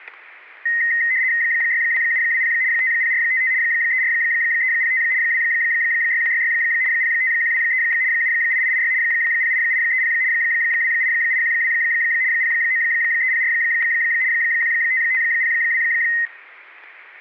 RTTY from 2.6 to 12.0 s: 50455 34305 26166 05123 78886 08830 28812

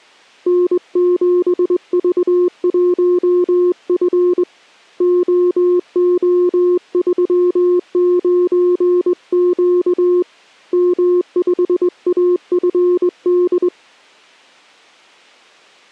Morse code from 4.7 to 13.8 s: OO39Q M5AFD

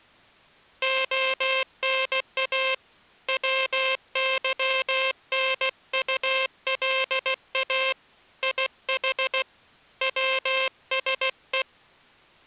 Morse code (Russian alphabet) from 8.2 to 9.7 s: ИХ

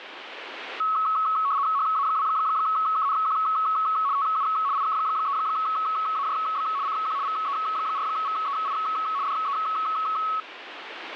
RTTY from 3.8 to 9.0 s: TU IK3AJB CQ VE4VEI

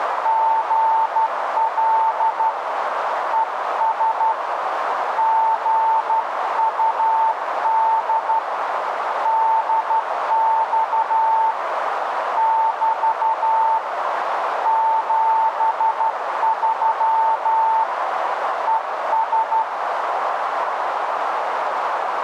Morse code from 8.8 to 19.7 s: DX <BT> 73 ES

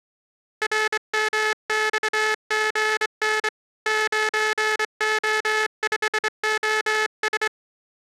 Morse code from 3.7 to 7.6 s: 9O5OS

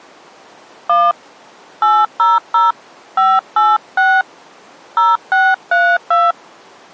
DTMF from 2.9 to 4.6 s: 586

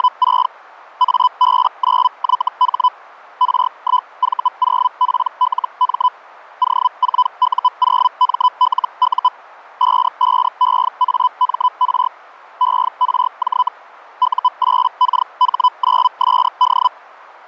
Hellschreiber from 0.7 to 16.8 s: AB9YH R1V0PLM O4U0MLU 55EAMR ERJ U8KH9SD

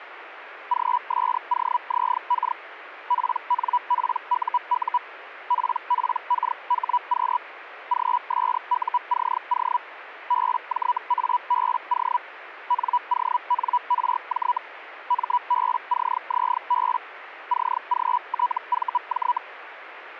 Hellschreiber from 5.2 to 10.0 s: PPKHQ GSUCO

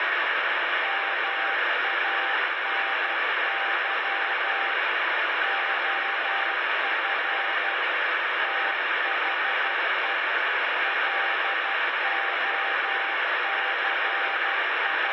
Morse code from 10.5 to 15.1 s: …

